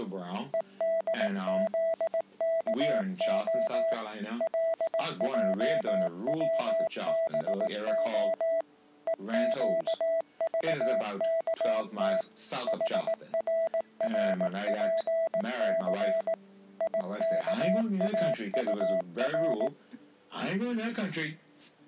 Morse code, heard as a keyed tone, machine-sent, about 18 wpm, 660 Hz. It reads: EDZKO LJWBO EQVKT HRRPC IKAUR